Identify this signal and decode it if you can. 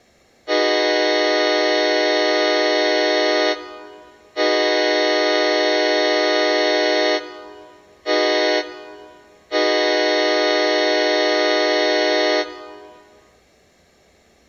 Train horn signal, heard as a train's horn, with room echo. 2 long, 1 short, 1 long. On North American railways: approaching a public crossing.